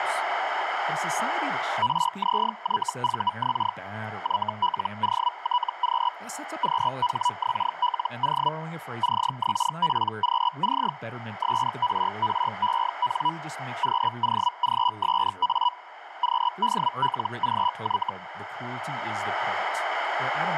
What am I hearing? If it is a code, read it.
Hellschreiber (Feld-Hell, 122.5 baud), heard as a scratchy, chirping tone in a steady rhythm, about 980 Hz, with radio static, a narrow filter and speech in English. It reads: RZYVX YLOTQ QHXLO CXPQC SRREN QOGSA QDLGY